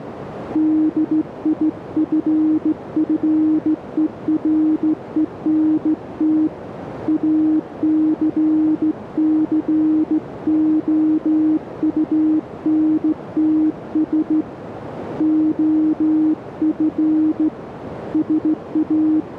Morse code, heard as a keyed tone, hand-sent with a straight key, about 15 wpm, 310 Hz, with radio static and a narrow filter. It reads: DIFFERENT ACCOUNTS OF …